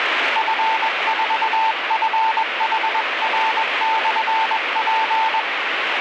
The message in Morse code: F4FHR/P

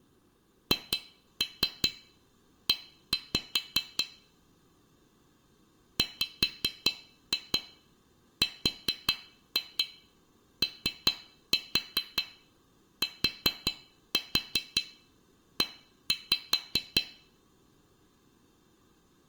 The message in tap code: HE WROTE

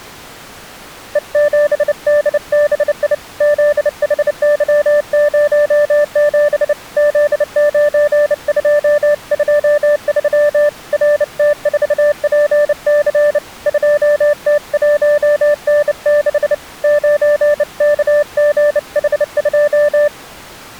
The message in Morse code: E7DBI ZHY07 Z9223 RT4PC 2T1N6 9KGH2

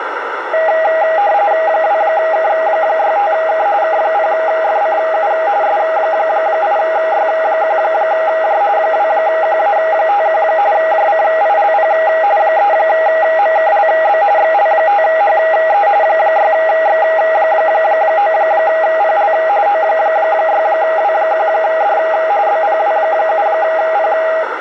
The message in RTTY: 2K65K K0FCU S8Y1J 2QA51 JCILP 3MKLB XL5HE 6X9PL O6W1D BPW7P

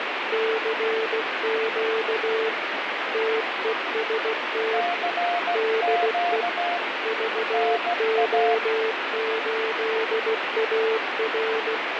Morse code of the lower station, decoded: CQ TEST DE VO8AR

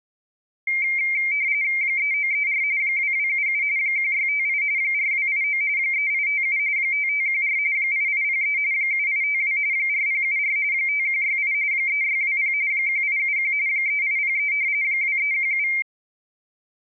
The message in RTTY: 3934 2277 1658 4289 3857 5514 8803 7852 4074 5168 3620 1871 3803 2317

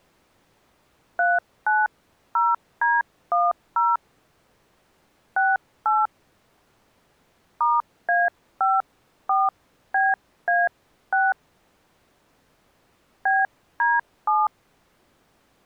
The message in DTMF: 390D10 68 *A54BA6 BD7

